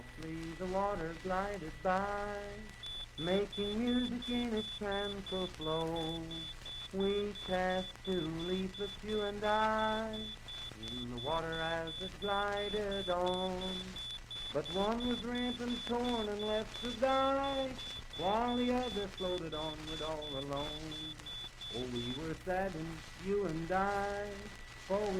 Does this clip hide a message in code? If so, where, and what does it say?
No, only evenly repeated beeps, with a steady whistle near 1960 Hz.